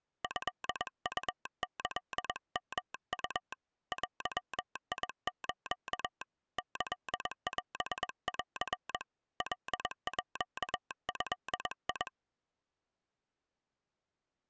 Morse code (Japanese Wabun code), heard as a telegraph sounder, hand-sent with a paddle, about 21 wpm. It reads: トウキヨウ デス キオン カード